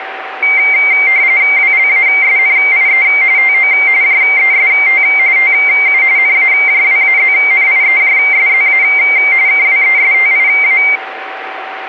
RTTY (45.45 baud, 170 Hz shift), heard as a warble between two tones, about 2200 Hz centre, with radio static and a steady whistle near 770 Hz. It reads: WLASNIE TO JEST TU NAJWAZNIEJSZA KWESTIA